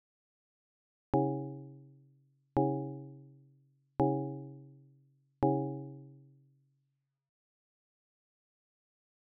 Clock strike, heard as a bell. 4. Four o'clock.